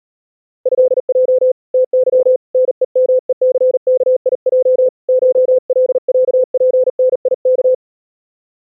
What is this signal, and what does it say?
Morse code (Russian alphabet), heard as a keyed tone, hand-sent with a paddle, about 40 wpm, 510 Hz. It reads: ЭЙ ТЫ НЕМЕЦКИЙ ШЛЯПНИК